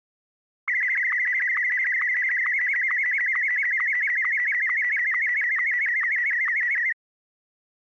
SSTV (slow-scan television), Martin M1, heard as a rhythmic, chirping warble.